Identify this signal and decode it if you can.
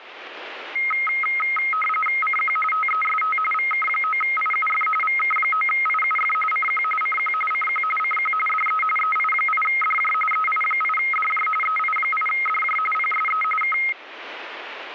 RTTY (45.45 baud, 850 Hz shift), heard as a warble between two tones, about 1700 Hz centre, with radio static. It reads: CQ TEST VK9IUF VK9IUF CQ CQ CQ CQ DE EI8DJ EI8DJ EI8DJ PSE K